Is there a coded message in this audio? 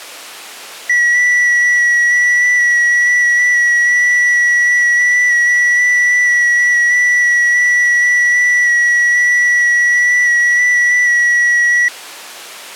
Yes: FT8 (one signal) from 0.9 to 11.9 s, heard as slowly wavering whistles, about 6.25 baud.